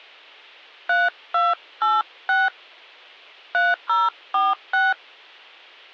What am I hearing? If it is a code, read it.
DTMF, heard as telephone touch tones, dialled by hand, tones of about 190 ms. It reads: 3286 3046